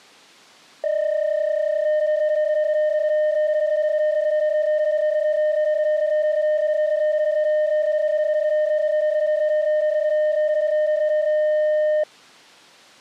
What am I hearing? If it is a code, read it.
PSK31 (31.25 baud), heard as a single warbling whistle, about 610 Hz.